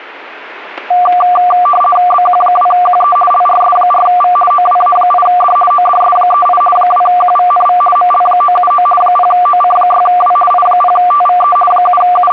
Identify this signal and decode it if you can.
RTTY (50 baud, 450 Hz shift), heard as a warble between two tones, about 940 Hz centre. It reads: BQ2QE LRS4V OWA8D ODS38 2QVNV ML979 0OC6W I0TVE …